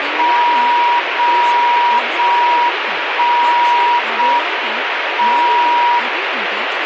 Radio time signal (JJY), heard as a tone whose level steps once a second, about 960 Hz, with radio static and speech in Gujarati. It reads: 0 0 1 0 M 0